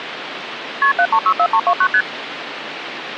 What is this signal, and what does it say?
Multi-frequency trunk signalling (R1, as on North American trunks), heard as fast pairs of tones, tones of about 70 ms, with phone line noise. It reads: KP 7364329 ST